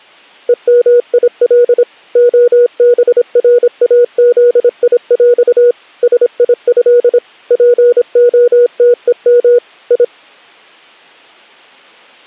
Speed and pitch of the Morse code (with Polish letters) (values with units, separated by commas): 26 wpm, 480 Hz